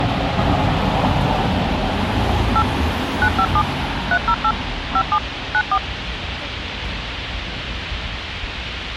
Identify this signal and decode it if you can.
DTMF, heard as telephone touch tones, dialled by machine, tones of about 60 ms, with radio hiss and the noise of a residential street. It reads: 8 957 308 57 94